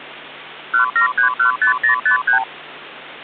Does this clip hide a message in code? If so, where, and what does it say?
Yes: multi-frequency trunk signalling (R2, with the far end's replies) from 0.7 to 2.4 s, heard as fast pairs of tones, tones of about 110 ms, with hum. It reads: 17315053